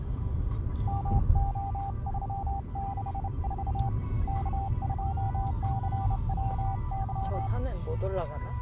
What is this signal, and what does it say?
Morse code, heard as a keyed tone, hand-sent with a straight key, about 28 wpm, 790 Hz, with the noise inside a car. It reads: MO364 K2CWY